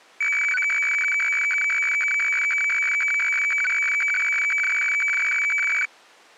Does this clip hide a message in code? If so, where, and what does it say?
Yes: weather fax (radiofax), 120 lines a minute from 0.2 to 5.9 s, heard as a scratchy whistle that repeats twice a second.